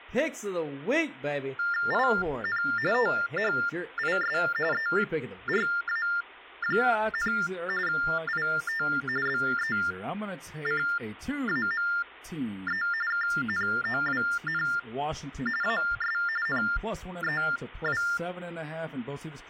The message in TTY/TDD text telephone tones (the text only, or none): IN THIS ERA, IT BECAME KNOWN AS NEW